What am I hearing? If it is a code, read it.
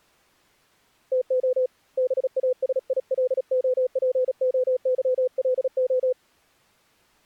Morse code (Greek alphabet), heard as a keyed tone, hand-sent with a paddle, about 36 wpm, 510 Hz. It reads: ΤΟ ΒΑΣΙΛΟΠΟΥΛΟ